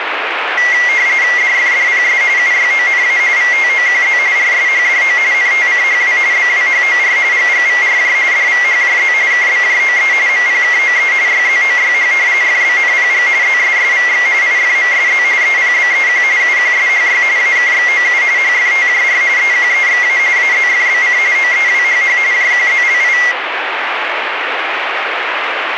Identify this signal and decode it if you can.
RTTY (45.45 baud, 170 Hz shift), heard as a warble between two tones, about 2050 Hz centre, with radio static. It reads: DFDPS UYONA VTOQZ RSHDO NTCHW BWHOR GGVRJ DVHJZ KBJOE MPKOE YZOYH FBNPG ZSSVX IFMSZ EPBEQ UQSHY AKXOU HFTJR EQEXA AZFBC OEWHH JQZLI